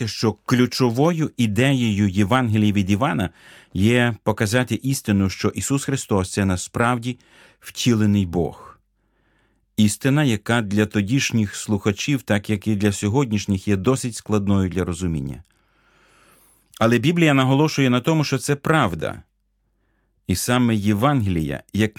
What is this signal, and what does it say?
Speech in Ukrainian. There is no code.